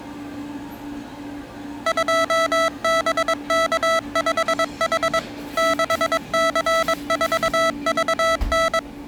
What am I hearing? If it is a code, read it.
Morse code, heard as electronic beeps, machine-sent, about 22 wpm, 660 Hz, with the noise of a cafe. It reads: 2BK5H 6C4VN